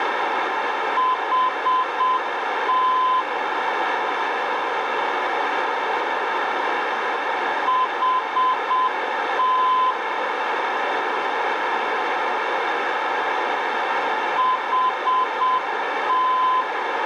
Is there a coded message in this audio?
Yes: Morse code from 0.9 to 16.7 s, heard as a keyed tone, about 7 wpm, 1020 Hz, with radio static and a narrow filter. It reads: HT HT HT